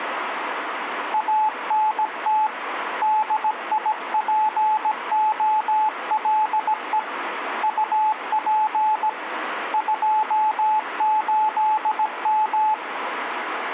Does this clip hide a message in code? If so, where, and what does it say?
Yes: Morse code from 1.1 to 12.8 s, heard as a keyed tone, hand-sent with a paddle, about 17 wpm, 860 Hz, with radio static. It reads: ANT DIPOLE UP 28M